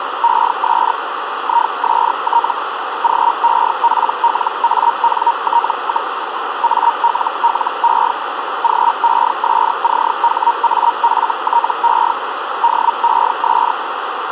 Hellschreiber (Feld-Hell, 122.5 baud), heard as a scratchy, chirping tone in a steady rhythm, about 940 Hz, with radio static and a narrow filter. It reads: ES IST GEPLANT, ALLE GESCHAFTE DES